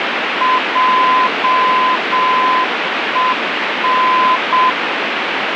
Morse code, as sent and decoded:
.--- . -.
JEN

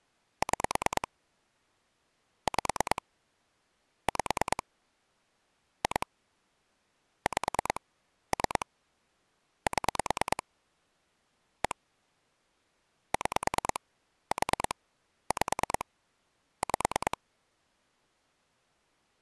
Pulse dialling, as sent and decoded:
6 / 5 / 5 / 2 / 5 / 3 / 7 / 1 / 6 / 4 / 5 / 5
6 5 5 2 5 3 7 1 6 4 5 5

